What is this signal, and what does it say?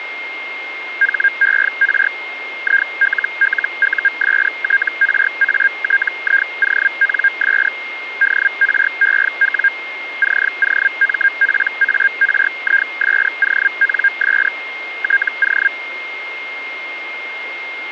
Hellschreiber (Feld-Hell, 122.5 baud), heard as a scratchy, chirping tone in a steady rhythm, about 1600 Hz, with a steady whistle near 2130 Hz. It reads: HER ILLUSTRATIONS DREW COMPARISONS TO